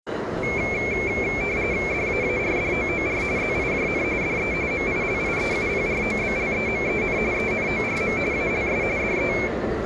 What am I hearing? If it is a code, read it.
RTTY (45.45 baud, 170 Hz shift), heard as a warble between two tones, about 2250 Hz centre, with the noise of a crowd indoors. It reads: DAARDOOR ZIJN DE MILIEUPROBLEMEN ENORM ALS DE